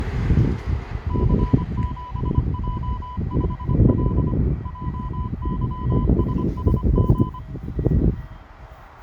Morse code, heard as a keyed tone, machine-sent, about 25 wpm, 1000 Hz, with radio static, a narrow filter and the noise of a residential street. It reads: C7J5L JYSSG